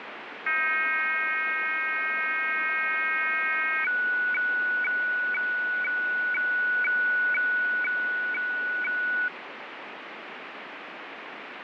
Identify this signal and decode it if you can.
Weather fax (radiofax), 120 lines a minute, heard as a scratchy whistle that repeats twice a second, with radio static.